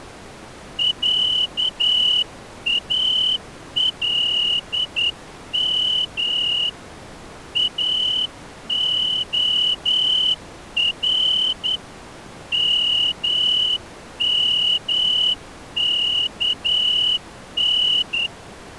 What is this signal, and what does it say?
Morse code (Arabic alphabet), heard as a whistle, hand-sent with a straight key, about 10 wpm. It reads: عالم اخر ممكن